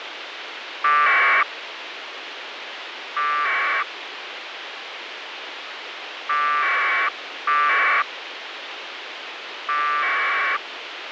Packet radio (AX.25, as in APRS), 1200 baud, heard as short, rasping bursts, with radio hiss.